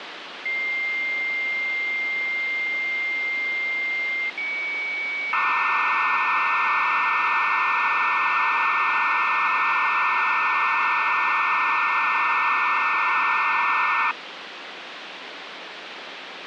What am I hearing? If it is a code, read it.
Dial-up modem handshake (low-speed, two carriers), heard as two whistles, then hiss, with phone line noise.